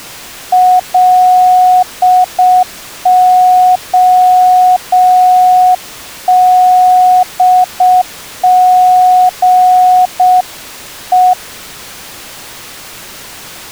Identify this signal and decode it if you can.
Morse code, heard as a keyed tone, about 6 wpm, 730 Hz. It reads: LODGE